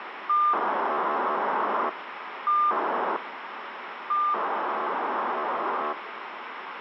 POCSAG pager data (2400 baud), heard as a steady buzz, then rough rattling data, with radio hiss.